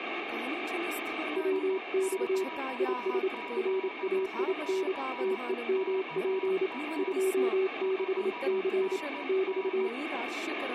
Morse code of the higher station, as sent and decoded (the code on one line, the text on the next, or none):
... --.- --... -.-. -.- .- / ..... -. -.
SQ7CKA 5NN